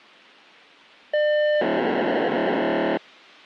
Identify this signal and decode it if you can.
POCSAG pager data (1200 baud), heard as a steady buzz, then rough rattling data.